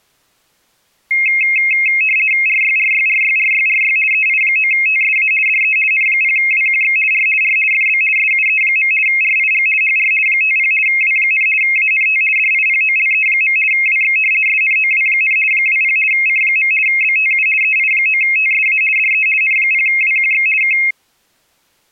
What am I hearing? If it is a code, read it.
RTTY (50 baud, 450 Hz shift), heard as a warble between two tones, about 2350 Hz centre. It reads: RYRYRYRYRY EI9TSA DE N0WQX R R FB SUE. RIG HR 50 W, ANT DIPOLE. WX SNOW, 20 C. BTU EI9TSA DE N0WQX K